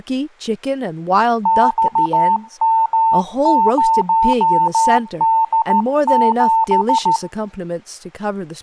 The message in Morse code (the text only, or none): XM0D7